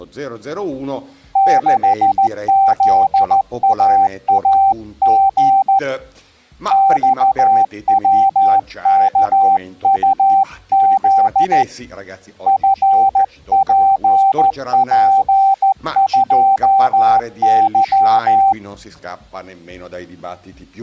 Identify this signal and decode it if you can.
Morse code, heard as a keyed tone, hand-sent with a straight key, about 14 wpm, 780 Hz. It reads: 6ZAAG XWKUZ FPP2Y